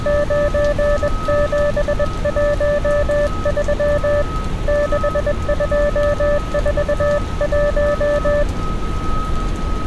Morse code, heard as a keyed tone, hand-sent with a paddle, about 21 wpm, 580 Hz, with street noise. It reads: 9713 6241